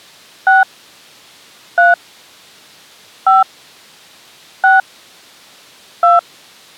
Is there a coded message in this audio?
Yes: DTMF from 0.5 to 6.2 s, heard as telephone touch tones, dialled by hand, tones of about 160 ms. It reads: 6 3 5 6 2